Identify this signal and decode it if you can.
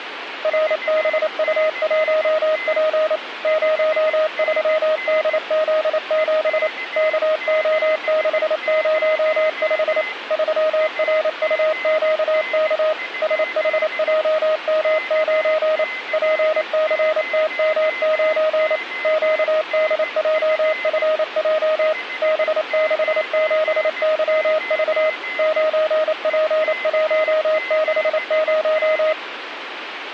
Morse code, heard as a keyed tone, machine-sent, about 28 wpm, 620 Hz, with radio static and a weaker station near 2050 Hz. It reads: RBU1P 03DZ7 KO605 3RUQK SHJM9 PCTM9 QDJFJ B67YV 9P160